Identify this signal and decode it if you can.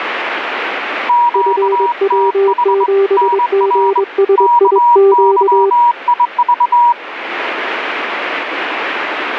Morse code, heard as two keyed tones, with radio static. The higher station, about 23 wpm, 960 Hz: QTH NR KYIV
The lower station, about 22 wpm, 390 Hz: FW7GSIQ